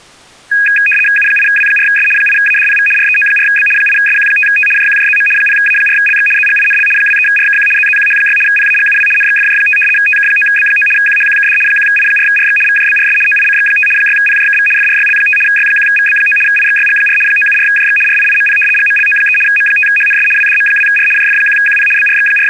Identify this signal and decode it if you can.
RTTY (75 baud, 850 Hz shift), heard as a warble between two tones, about 2050 Hz centre. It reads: U8W4S 8ADPV REO4B 8SQ5T JQJZM 0A4LX ZGINL 23RKQ ZZQH6 PAGUW NXFJ5 TK9B9 QHQKD 1I4RX VJBRS OICX5 6PJKV FRYL5 Y1VB9 IXYG4 974JX RIIMP GMLO3 M5HNS WDM2R JF1QP …